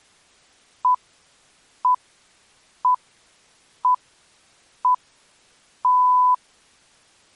Radio time signal (six pips, as the Greenwich Time Signal), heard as pips.